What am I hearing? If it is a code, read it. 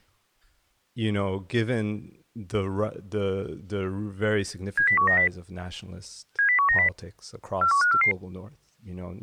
Five-tone selective call (CCIR), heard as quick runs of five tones, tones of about 100 ms, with speech in English. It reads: 70190 70190 41544